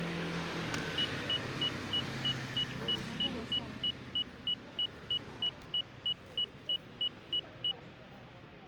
Evenly repeated beeps, with the noise of a residential street. There is no code.